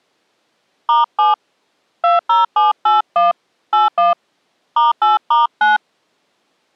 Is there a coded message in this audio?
Yes: DTMF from 0.9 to 5.8 s, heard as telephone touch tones, dialled by hand, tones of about 160 ms. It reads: *7 20781 81 *8*9